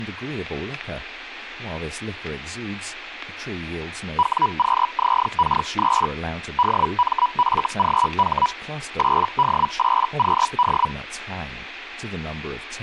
Hellschreiber (Feld-Hell, 122.5 baud), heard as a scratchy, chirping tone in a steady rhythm, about 980 Hz, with static crashes and speech in English. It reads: WQZK3 DMFGH 8D8QD